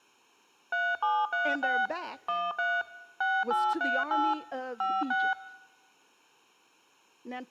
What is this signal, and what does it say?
DTMF, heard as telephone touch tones, dialled by machine, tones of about 230 ms. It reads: 3736 13 6838 56